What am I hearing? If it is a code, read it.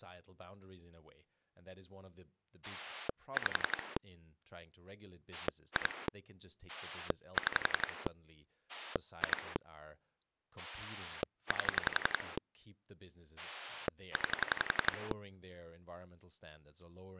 Pulse dialling, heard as a rotary dial, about 11 pulses a second, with speech in English. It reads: 5 2 6 2 8 9